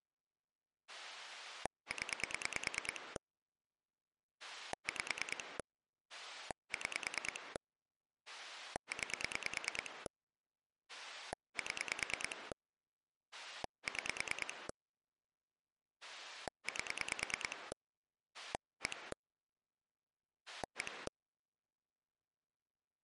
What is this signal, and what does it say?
Pulse dialling, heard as a rotary dial, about 9 pulses a second. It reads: 0 5 6 9 7 6 8 1 1